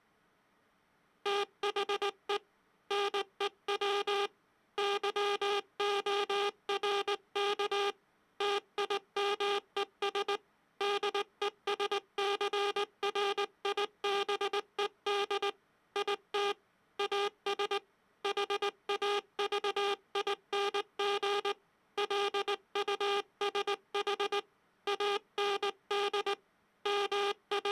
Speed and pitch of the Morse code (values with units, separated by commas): 19 wpm